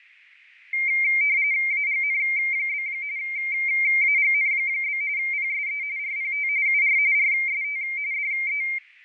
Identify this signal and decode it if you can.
RTTY (45.45 baud, 170 Hz shift), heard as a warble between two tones, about 2200 Hz centre, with radio static. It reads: AGN? AGN? PSE RPT UR RST DE